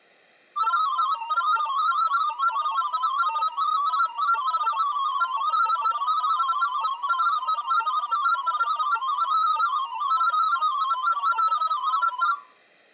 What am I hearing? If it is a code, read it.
Multi-tone FSK (Olivia or MFSK type), about 500 Hz wide, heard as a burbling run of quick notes, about 31.25 baud.